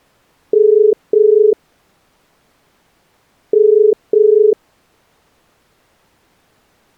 Telephone call progress tone (as in the UK, Ireland, Australia and similar networks), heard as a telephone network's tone, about 430 Hz. Ringback tone.